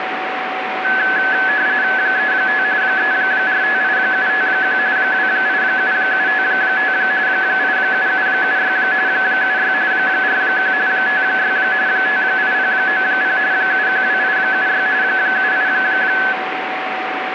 RTTY (45.45 baud, 170 Hz shift), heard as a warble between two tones, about 1600 Hz centre, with radio static and a steady whistle near 750 Hz. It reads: 35 3458751 287755 87776 76 41 56 58090 712876 78